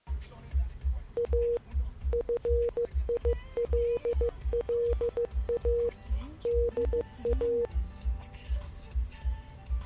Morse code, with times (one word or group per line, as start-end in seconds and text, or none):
1.2-1.6 A
2.1-5.9 FILLA
6.5-7.7 DA